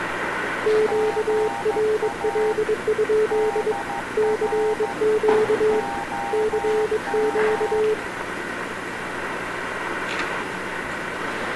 Morse code, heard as two keyed tones, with radio static. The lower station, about 22 wpm, 430 Hz: QRL? CQ CQ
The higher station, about 13 wpm, 800 Hz: GA DR OM